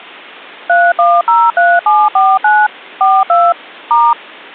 DTMF, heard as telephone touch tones, dialled by machine, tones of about 230 ms. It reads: 3103749 42 *